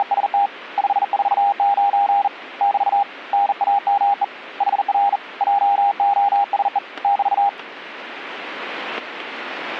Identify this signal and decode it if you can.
Morse code, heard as a keyed tone, hand-sent with a bug key, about 40 wpm, 800 Hz. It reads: … 549 <BT> NAME HR JOSE <BT>